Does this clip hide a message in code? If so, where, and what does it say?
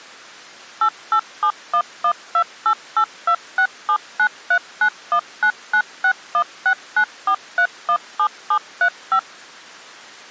Yes: DTMF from 0.8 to 9.2 s, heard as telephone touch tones, dialled by machine, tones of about 80 ms. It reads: 8871128826793919961694317735